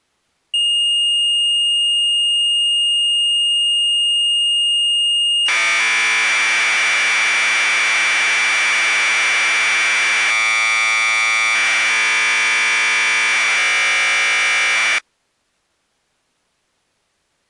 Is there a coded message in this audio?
Yes: Commodore tape loading (standard loader) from 0.5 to 15.0 s, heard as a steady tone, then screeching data.